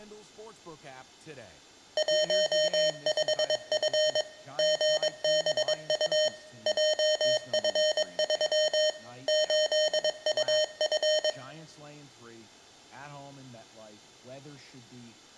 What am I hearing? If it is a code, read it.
Morse code, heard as electronic beeps, machine-sent, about 22 wpm, 620 Hz, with room echo and speech in English. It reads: 15F GBU JF3 8UF